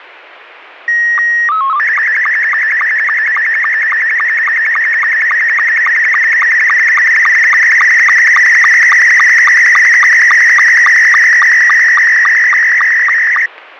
SSTV (slow-scan television), Scottie S2, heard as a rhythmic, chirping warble, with radio static.